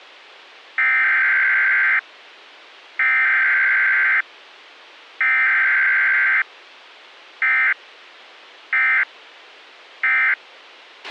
Emergency Alert System (SAME) tones (header bursts, then end-of-message bursts), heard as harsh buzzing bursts, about 520.83 baud, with a squelch burst at the end.